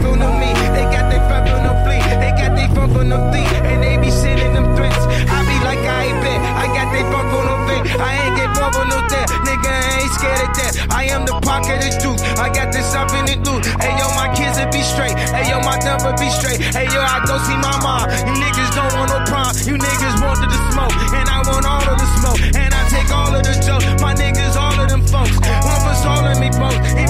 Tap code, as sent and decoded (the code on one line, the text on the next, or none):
none